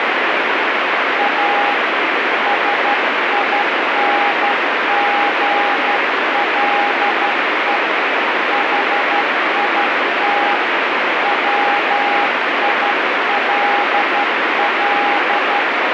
Morse code, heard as a keyed tone, hand-sent with a straight key, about 12 wpm, 820 Hz, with heavy radio static. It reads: A SINGLE HIT WILL